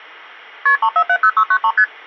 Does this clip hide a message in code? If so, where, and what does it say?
Yes: multi-frequency trunk signalling (R1, as on North American trunks) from 0.7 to 1.8 s, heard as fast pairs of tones, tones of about 70 ms. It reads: KP 3470693 ST